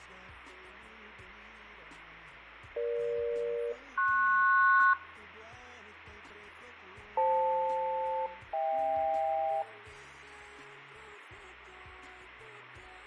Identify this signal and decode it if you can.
Aircraft SELCAL, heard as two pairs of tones, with radio static. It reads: EG-PS FL-HK